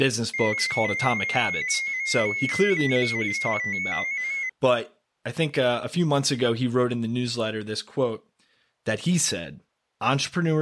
Multi-tone FSK (Olivia or MFSK type), about 250 Hz wide, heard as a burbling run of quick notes, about 15.625 baud, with speech in English.